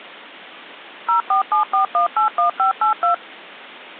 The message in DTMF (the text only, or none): 0474181582